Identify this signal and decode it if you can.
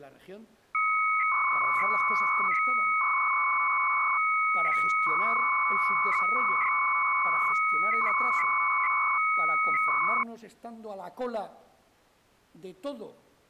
300-baud modem data (Bell 103 tones), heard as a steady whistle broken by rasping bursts, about 300 baud, 200 Hz shift.